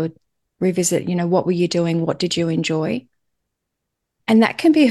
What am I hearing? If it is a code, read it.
Speech in English. There is no code.